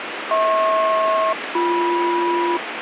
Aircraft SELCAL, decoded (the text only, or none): HP-BM